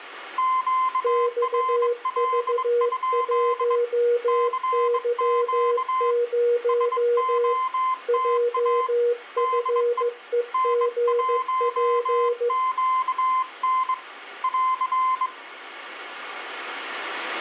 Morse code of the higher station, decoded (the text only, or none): QRL? CQ SOTA DE N1QN <AR>